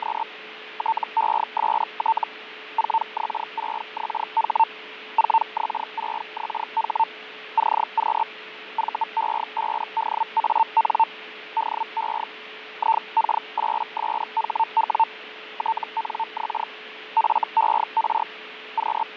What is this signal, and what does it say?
Hellschreiber (Feld-Hell, 122.5 baud), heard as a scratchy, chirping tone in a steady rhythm, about 900 Hz, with radio static, fading and a steady whistle near 430 Hz. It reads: … TEST 4X6XH 4X6XH CQ VE5DAN DE IK8SHW TNX FER …